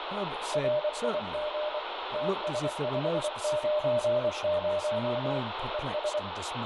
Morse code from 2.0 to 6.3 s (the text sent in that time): TS590 ES